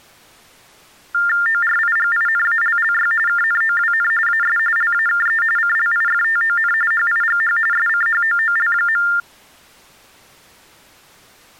TTY/TDD text telephone tones (45.45 baud Baudot), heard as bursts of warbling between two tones, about 400 Hz shift, 1600 Hz centre. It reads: ORIGINALLY KNOWN AS LAKE CLIFTON HIGH SCHOOL.